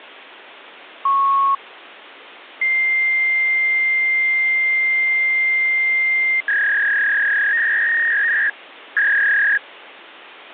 Fax machine handshake, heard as a beep, a long tone and a warble, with phone line noise.